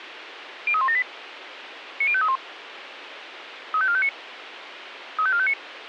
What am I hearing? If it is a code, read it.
Five-tone selective call (ZVEI), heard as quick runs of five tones, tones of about 70 ms, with radio hiss. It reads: 03178 90531 35459 35459